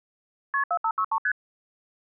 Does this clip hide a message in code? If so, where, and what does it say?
Yes: multi-frequency trunk signalling (R1, as on North American trunks) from 0.5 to 1.3 s, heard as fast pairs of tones, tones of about 70 ms. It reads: KP 4563 ST